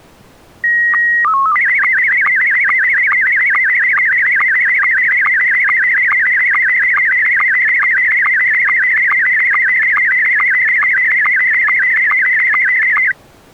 SSTV (slow-scan television), Scottie S1, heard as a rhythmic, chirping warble.